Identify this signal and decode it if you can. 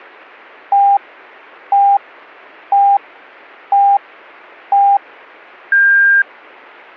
Radio time signal (five pips and a higher one, as on Chinese radio), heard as pips.